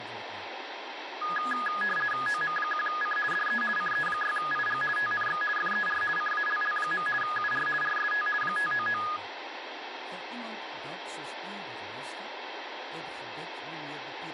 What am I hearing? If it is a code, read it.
RTTY (50 baud, 450 Hz shift), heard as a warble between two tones, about 1450 Hz centre, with radio static and speech in Afrikaans. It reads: OM1C DE CE6IG TNX FER CALL. UR RST 599